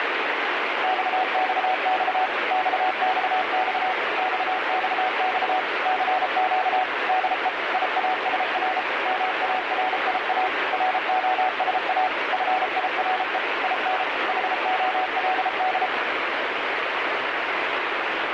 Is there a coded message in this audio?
Yes: Morse code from 0.8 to 15.9 s, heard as a keyed tone, machine-sent, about 33 wpm, 750 Hz, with heavy radio static. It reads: XXX XXX XXX CQ DE IASR MARIA ROSA FIRE IN HOLD